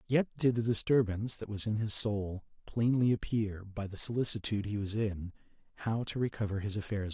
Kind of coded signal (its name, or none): none